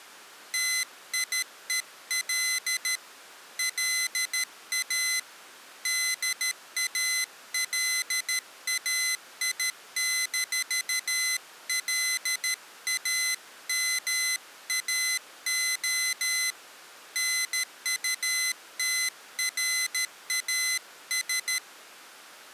Morse code, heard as a high beeper, hand-sent with a paddle, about 13 wpm, 2050 Hz. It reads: TIEL LA DALAI-LAMAO NUTRAS